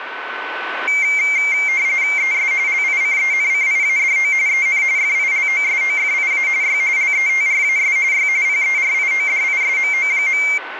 RTTY (45.45 baud, 170 Hz shift), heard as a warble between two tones, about 2200 Hz centre, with radio static and a steady whistle near 1510 Hz. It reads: ES LICENCIADO EN FILOSOFIA Y LETRAS Y PERIODISMO.